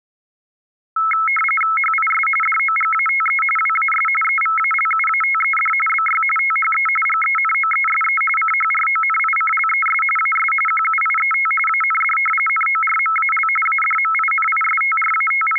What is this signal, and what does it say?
RTTY (45.45 baud, 850 Hz shift), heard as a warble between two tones, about 1750 Hz centre. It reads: HIS DOGATE WAS EVALUATED BY THE GENOESE CHRONICLES AS QUIET AND NORMAL …